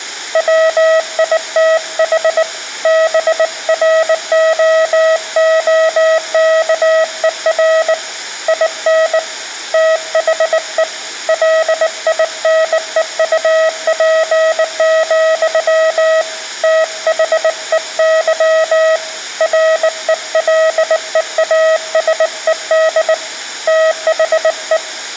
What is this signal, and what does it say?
Morse code, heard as a keyed tone, hand-sent with a bug key, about 19 wpm, 640 Hz, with room echo. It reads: WITH BROOKER IN THE LINEUP, THEY RELEASED THE